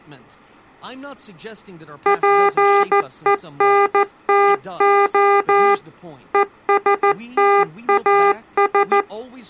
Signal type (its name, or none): Morse code